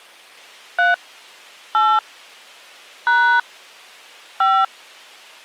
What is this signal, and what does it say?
DTMF, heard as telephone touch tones, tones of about 250 ms. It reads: 3 8 # 5